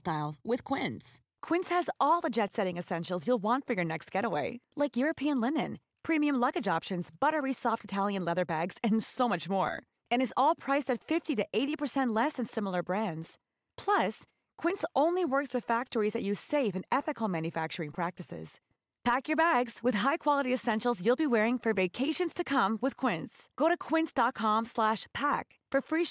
Speech in Persian. There is no code.